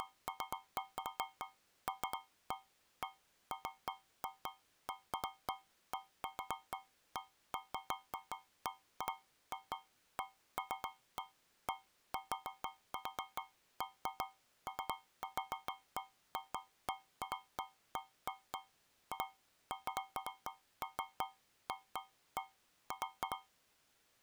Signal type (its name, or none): none